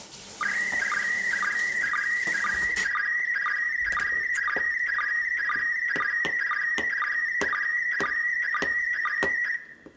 SSTV (slow-scan television), PD 120, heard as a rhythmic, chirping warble, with room echo and kitchen noise.